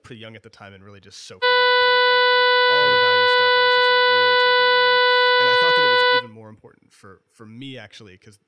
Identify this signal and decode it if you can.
Ship horn signal, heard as a ship's horn, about 500 Hz, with speech in English. 1 long. At sea: a vessel nearing a blind bend, or under power and making way in fog.